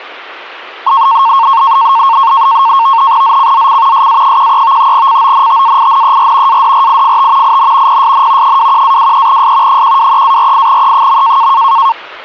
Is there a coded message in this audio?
Yes: NAVTEX (SITOR-B), 100 baud, 170 Hz shift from 0.9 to 11.9 s, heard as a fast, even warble, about 1000 Hz centre. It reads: ZCZC SA13 CONTAINER ADRIFT IN PSN 21-23S 123-48E.